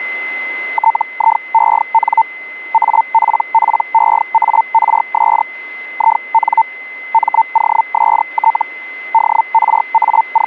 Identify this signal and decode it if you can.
Hellschreiber (Feld-Hell, 122.5 baud), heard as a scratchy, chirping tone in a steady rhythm, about 900 Hz, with a steady whistle near 2050 Hz. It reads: TIEN APPEARS IN MOST …